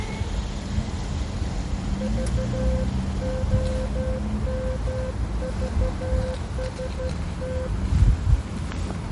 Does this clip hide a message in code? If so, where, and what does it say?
Yes: Morse code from 1.9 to 7.7 s, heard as a keyed tone, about 13 wpm, 520 Hz, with the noise of a residential street. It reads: VOMVST